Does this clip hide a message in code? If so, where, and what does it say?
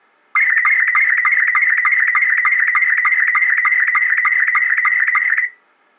Yes: SSTV (slow-scan television), Robot 72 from 0.4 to 5.5 s, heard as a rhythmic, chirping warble.